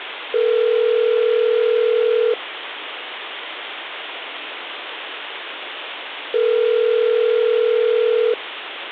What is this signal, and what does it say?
Telephone call progress tone (North American plan), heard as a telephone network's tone, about 440, 480 Hz, 2 s on and 4 s off, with phone line noise. Ringback tone.